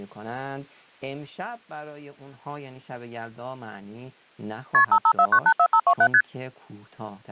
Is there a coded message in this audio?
Yes: multi-frequency trunk signalling (R1, as on North American trunks) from 4.7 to 6.2 s, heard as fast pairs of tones, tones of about 70 ms, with speech in Persian. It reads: KP 554984527 ST